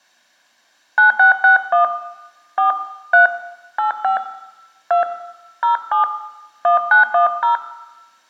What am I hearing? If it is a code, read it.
DTMF, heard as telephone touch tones, dialled by hand, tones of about 120 ms, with room echo. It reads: 9661 4 3 85 2 07 1910